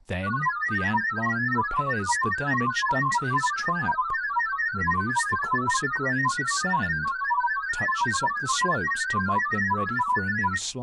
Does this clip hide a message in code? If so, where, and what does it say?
Yes: multi-tone FSK (Olivia or MFSK type), about 1000 Hz wide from 0.2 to 10.6 s, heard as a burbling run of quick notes, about 31.25 baud, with speech in English.